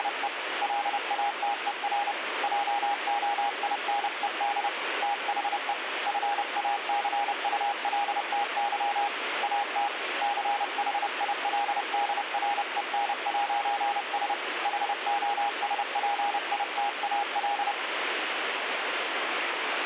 Morse code, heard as a keyed tone, hand-sent with a paddle, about 30 wpm, 820 Hz, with radio static. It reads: … LATER JOINED THE FACULTY AT CHILDREN'S HOSPITAL